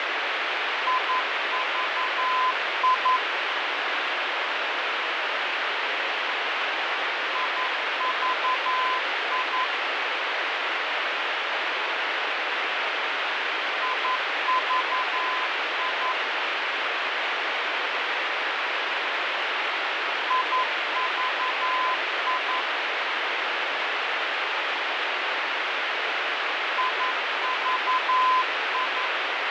Morse code, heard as a keyed tone, machine-sent, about 11 wpm, 1020 Hz, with heavy radio static and fading. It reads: IVI IVI IVI IVI IVI